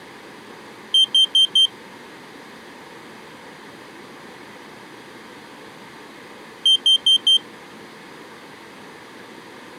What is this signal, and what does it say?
Alarm pattern, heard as an alarm's beeps, played twice, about 3150 Hz. Temporal four. Carbon monoxide.